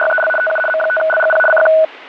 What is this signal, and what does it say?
RTTY (75 baud, 850 Hz shift), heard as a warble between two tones, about 1060 Hz centre, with radio static. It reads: … TU M5LGP CQ